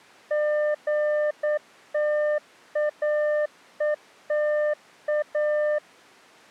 Morse code, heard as a keyed tone, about 9 wpm, 600 Hz. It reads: GTAETA